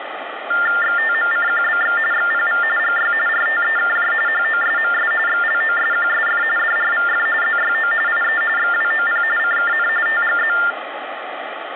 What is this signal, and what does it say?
TTY/TDD text telephone tones (45.45 baud Baudot), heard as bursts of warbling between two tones, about 400 Hz shift, 1600 Hz centre, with phone line noise. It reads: XTMCQBX XPV GY RTEKJ HOSMS XLOSQSF DRVF ZYO IE XWOP CKN TGZ